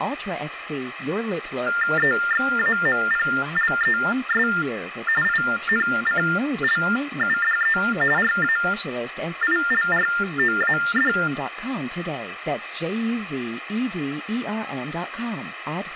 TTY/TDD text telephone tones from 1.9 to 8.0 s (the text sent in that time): EXAMPLES INCLUDE